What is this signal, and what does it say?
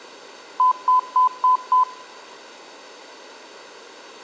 Beep code, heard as beeps, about 1010 Hz, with room echo. 5 short. In AMI BIOS tables: processor failure; in Dell tables: CMOS battery failure.